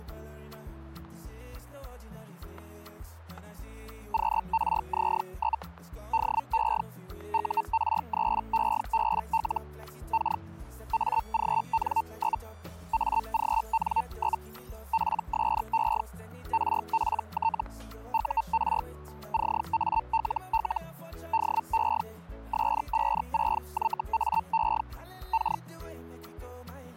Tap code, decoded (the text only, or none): none